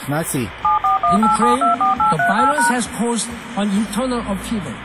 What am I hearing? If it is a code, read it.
DTMF, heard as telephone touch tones, dialled by machine, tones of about 130 ms, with phone line noise. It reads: 7418724838#